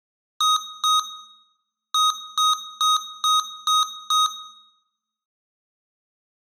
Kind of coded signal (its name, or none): beep code